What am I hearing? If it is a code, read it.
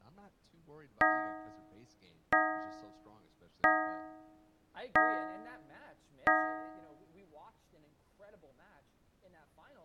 Clock strike, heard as a bell, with speech in English. 5. Five o'clock.